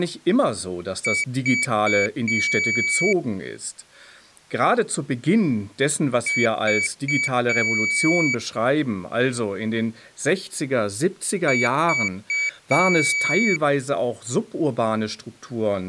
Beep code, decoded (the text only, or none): 3 short, 1 long